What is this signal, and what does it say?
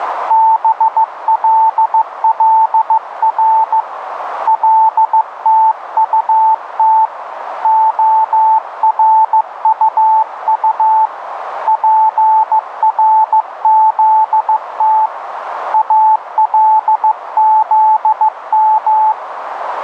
Morse code (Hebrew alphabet), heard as a keyed tone, hand-sent with a paddle, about 15 wpm, 880 Hz, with radio static and a narrow filter. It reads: בללר לתטת הרטט פרזת אלזם